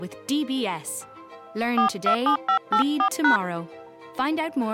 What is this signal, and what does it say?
DTMF, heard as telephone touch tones, dialled by hand, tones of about 100 ms. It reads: 427584#